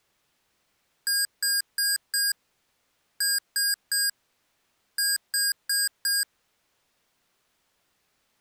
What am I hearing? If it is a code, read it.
Beep code, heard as beeps from a small speaker, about 1600 Hz. 4-3-4. In Phoenix BIOS tables: time-of-day clock failure.